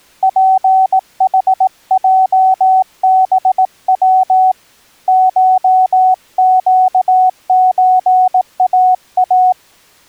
Morse code (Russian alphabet), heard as a keyed tone, hand-sent with a paddle, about 18 wpm, 750 Hz. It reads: ПХЙБВ ШЩЧАА